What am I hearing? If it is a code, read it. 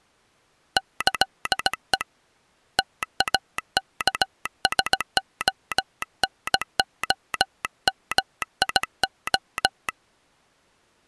Morse code (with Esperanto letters), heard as a telegraph sounder, hand-sent with a paddle, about 17 wpm. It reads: ĈE TAKSONOMIO